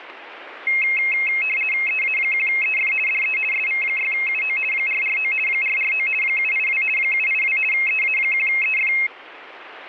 RTTY (50 baud, 450 Hz shift), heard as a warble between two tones, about 2350 Hz centre, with radio static. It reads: EA1EF DE SV6UO 449 449 782 782 EA1EF